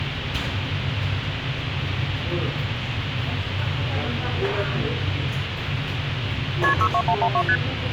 Multi-frequency trunk signalling (R1, as on North American trunks), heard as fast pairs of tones, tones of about 70 ms, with phone line noise and the noise of a restaurant. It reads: KP 62112 ST